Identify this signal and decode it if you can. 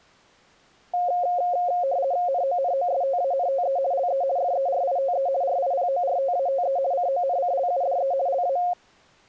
RTTY (50 baud, 170 Hz shift), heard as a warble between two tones, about 630 Hz centre. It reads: NONOSTANTE LE FERITE RIPORTATE CONCLUDE LA